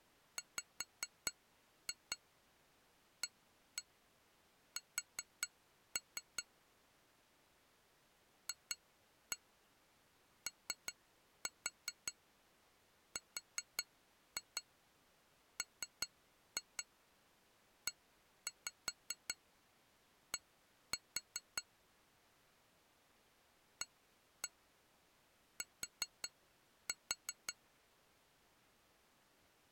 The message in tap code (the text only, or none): WAS FORMED AT